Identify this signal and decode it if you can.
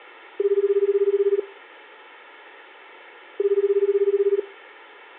Telephone call progress tone (Japanese plan), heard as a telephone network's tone, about 380, 400, 420 Hz, 1 s on and 2 s off, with room echo. Ringback tone.